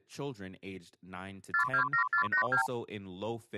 Multi-frequency trunk signalling (R2, with the far end's replies), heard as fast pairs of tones, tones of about 100 ms, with speech in English. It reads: 427482